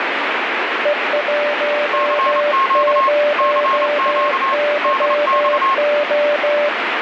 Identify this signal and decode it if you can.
Morse code, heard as two keyed tones, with heavy radio static. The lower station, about 16 wpm, 590 Hz: E10YO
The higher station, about 28 wpm, 1080 Hz: CQ CQ DX